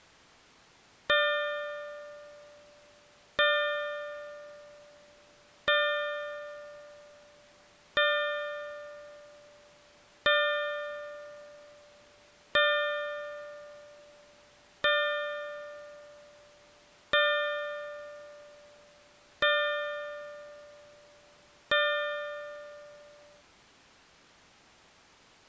Clock strike, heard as a bell. 10. Ten o'clock.